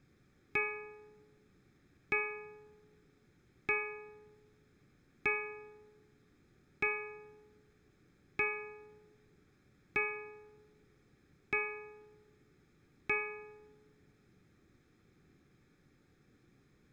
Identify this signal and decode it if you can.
Clock strike, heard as a bell. 9. Nine o'clock.